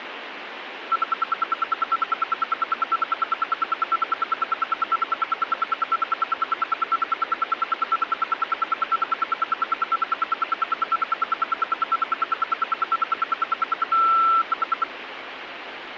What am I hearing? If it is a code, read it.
Radio time signal (RWM, Moscow), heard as ten pulses a second, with radio static.